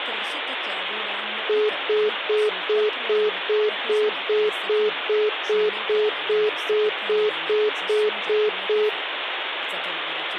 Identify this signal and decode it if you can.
Telephone call progress tone (single-tone plan, as in most of Europe), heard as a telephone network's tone, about 420 Hz, 0.2 s on and 0.2 s off, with phone line noise. Congestion tone.